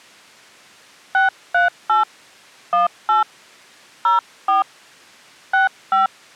DTMF, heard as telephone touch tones, dialled by hand, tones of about 140 ms. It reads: 638 18 04 65